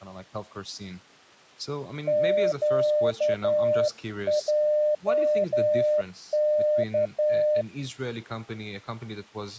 Morse code, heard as a keyed tone, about 11 wpm, 600 Hz, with speech in English. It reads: QJK